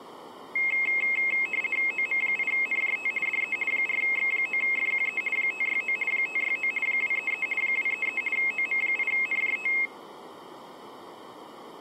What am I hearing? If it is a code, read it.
RTTY (50 baud, 450 Hz shift), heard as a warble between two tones, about 2350 Hz centre. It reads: OM8NJT DE 4X9FQE 569 569 233 233 OM8NJT